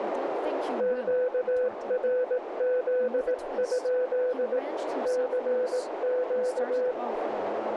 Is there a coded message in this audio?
Yes: Morse code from 0.7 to 7.0 s, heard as a keyed tone, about 18 wpm, 500 Hz, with radio static, a narrow filter and speech in English. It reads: QRZ? CQ